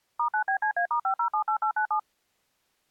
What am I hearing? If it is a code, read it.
DTMF, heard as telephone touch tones, dialled by machine, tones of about 90 ms. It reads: *9BCA*5078897